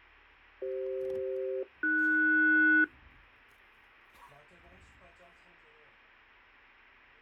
Aircraft SELCAL, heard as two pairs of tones, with fading and the noise inside a car. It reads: CF-AS